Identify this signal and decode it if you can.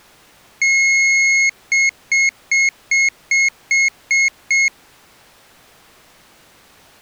Beep code, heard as a piezo beeper, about 2150 Hz. 1 long, 8 short. In AMI BIOS tables: display or retrace test failure.